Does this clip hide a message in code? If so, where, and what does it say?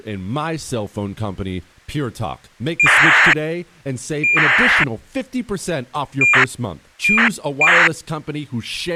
Yes: ACARS aircraft data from 2.8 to 7.9 s, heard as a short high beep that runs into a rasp, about 2400 baud, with speech in English.